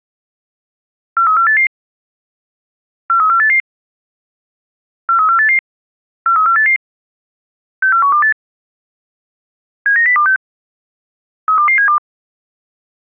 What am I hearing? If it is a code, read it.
Five-tone selective call (CCIR), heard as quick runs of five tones, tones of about 100 ms. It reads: 43488 43488 43488 43488 64128 79026 32272